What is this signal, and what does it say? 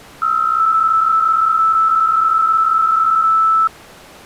PSK63 (62.5 baud), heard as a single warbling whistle, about 1320 Hz.